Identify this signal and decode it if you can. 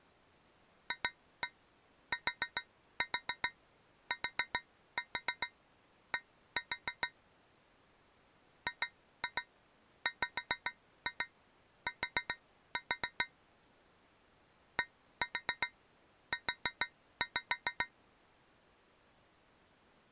Tap code, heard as taps on a metal pipe, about 7 knocks a second. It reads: FTTD GWT DU